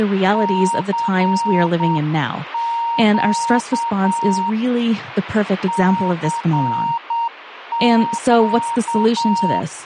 Morse code, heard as a keyed tone, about 8 wpm, 930 Hz, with radio static and speech in English. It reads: CQ CQ